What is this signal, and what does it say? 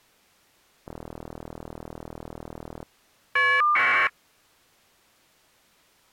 Caller ID data burst, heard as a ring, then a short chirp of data, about 1200 baud.